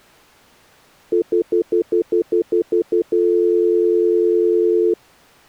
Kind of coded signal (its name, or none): telephone call progress tone